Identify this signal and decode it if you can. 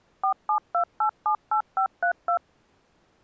DTMF, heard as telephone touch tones, dialled by machine, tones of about 90 ms. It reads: 472878532